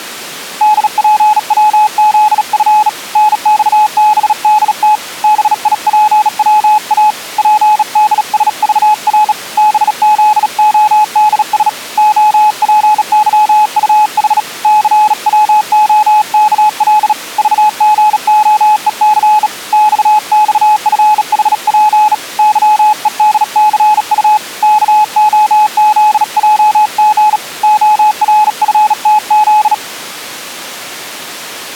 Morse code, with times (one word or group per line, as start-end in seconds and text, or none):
0.6-2.9 DPWZF
3.2-5.0 NXBDT
5.2-7.1 BIPWA
7.4-9.3 PDSVR
9.6-11.7 BZODS
12.0-14.4 OPYUH
14.6-17.1 CWOKL
17.4-19.5 VGOEC
19.7-22.1 XXFHP
22.4-24.4 YEDCU
24.6-27.4 KOZJG
27.6-29.7 ORFTZ